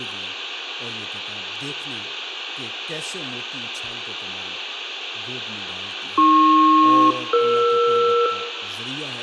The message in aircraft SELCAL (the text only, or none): AP-ER